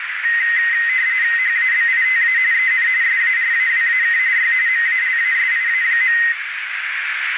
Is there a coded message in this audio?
Yes: RTTY (45.45 baud, 170 Hz shift) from 0.2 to 6.3 s, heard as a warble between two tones, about 1950 Hz centre, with radio static and a narrow filter. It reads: HABITA EN SARAWAK Y MALASIA.